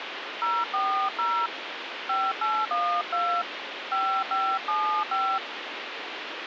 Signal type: DTMF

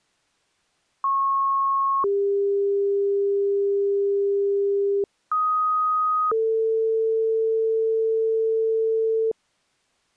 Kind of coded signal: two-tone page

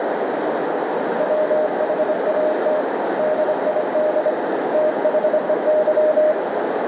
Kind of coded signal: Morse code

